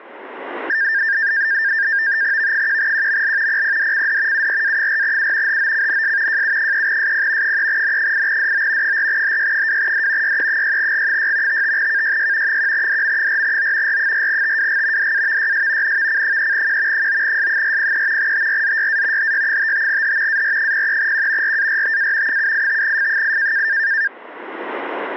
NAVTEX (SITOR-B), 100 baud, 170 Hz shift, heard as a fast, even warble, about 1700 Hz centre, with static crashes. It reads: V1QML PPDCD URA4U HOCNS JU3SP 3N8DO 4HY2D YE6G6 55KYY 1DM4O R4TWG DAVYS NVC3Q 9S403 TRZYA HY55H AR03Q RARTA 785F8